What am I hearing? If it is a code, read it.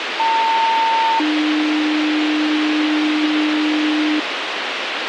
Two-tone page, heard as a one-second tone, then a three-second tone, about 900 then 300 Hz, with radio hiss.